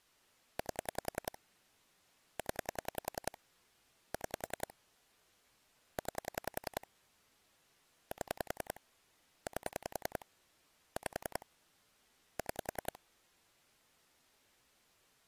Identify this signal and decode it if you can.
Pulse dialling, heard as clicks on a phone line, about 10 pulses a second. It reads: 8 0 6 9 7 8 5 6